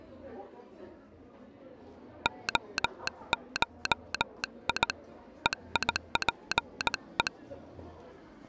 Morse code (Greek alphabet), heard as a telegraph sounder, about 18 wpm, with the noise of a crowd indoors. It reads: ΟΧΙ ΕΙΠΕ